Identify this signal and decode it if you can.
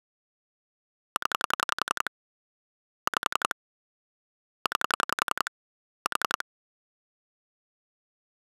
Pulse dialling, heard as clicks on a phone line, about 11 pulses a second. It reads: 0 5 9 4